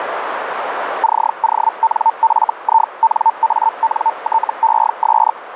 Hellschreiber (Feld-Hell, 122.5 baud), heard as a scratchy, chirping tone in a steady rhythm, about 900 Hz, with radio static and a narrow filter. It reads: CONFINANTES